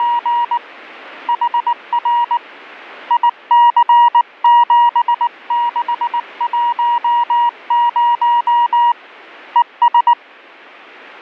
Morse code, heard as a keyed tone, hand-sent with a paddle, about 19 wpm, 950 Hz. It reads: … HR IC7610 ES